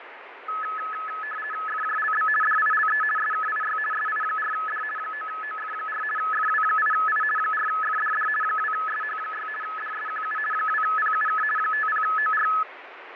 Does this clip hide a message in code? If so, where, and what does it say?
Yes: RTTY (50 baud, 450 Hz shift) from 0.5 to 12.6 s, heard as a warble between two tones, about 1500 Hz centre, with radio static and fading. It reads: FJLB DILE SKIY SI4D 9OF4 FW8I 4FDD 2SH6 DSQU 2PUK 50OR